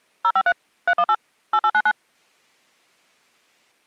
DTMF, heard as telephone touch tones, dialled by machine, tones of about 60 ms. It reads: 053 318 8899